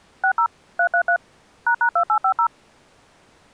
DTMF, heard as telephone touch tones, dialled by machine, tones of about 80 ms. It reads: 60 333 ##2850